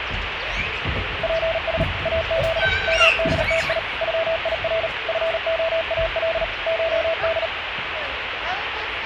Morse code (Persian alphabet), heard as a keyed tone, machine-sent, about 38 wpm, 660 Hz, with radio static and the noise of a park. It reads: پس از مدتی غیر فعال شد